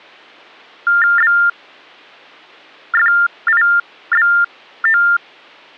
TTY/TDD text telephone tones (45.45 baud Baudot), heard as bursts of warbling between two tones, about 400 Hz shift, 1600 Hz centre. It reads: BFIBO